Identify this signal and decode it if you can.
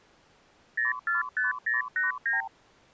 Multi-frequency trunk signalling (R2, with the far end's replies), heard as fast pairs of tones, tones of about 150 ms. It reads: 045089